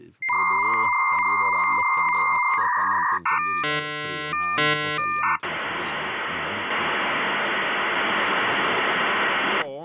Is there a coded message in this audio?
Yes: dial-up modem handshake (V.34 or later) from 0.2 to 9.6 s, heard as a whistle, warbles, then hiss, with speech in Swedish.